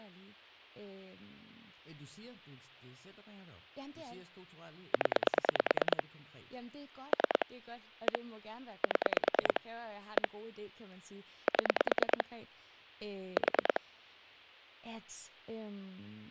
Pulse dialling, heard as clicks on a phone line, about 9 pulses a second, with speech in Danish. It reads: 0 3 1 7 1 7 4